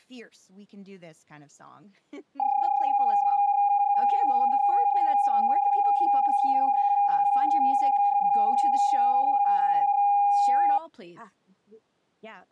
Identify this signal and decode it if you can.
PSK31 (31.25 baud), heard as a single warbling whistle, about 810 Hz, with speech in English.